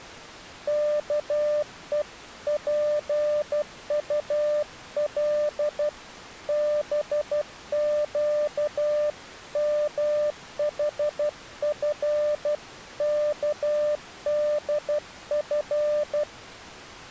Morse code (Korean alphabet), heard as a keyed tone, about 12 wpm, 600 Hz. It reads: 아직 대문은